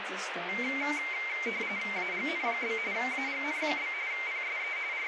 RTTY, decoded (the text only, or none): AGN? AGN? PSE …